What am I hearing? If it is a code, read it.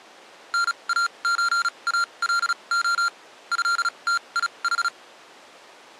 Morse code (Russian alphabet), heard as electronic beeps, machine-sent, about 36 wpm, spaced as for 27 wpm, 1390 Hz. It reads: НАЧАЛО ЭТИХ